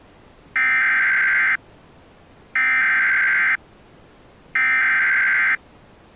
Emergency Alert System (SAME) tones (header bursts), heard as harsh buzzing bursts, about 520.83 baud.